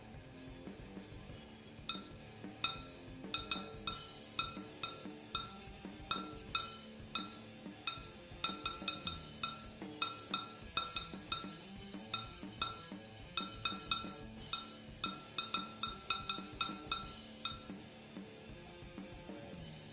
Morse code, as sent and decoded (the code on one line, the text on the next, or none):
none